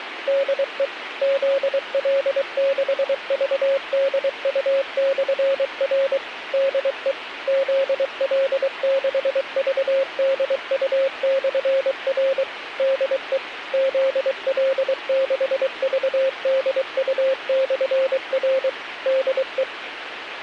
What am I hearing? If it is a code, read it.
Morse code, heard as a keyed tone, machine-sent, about 23 wpm, 540 Hz, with radio hiss. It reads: DE ZL6VDU/R DE ZL6VDU/R DE ZL6VDU/R DE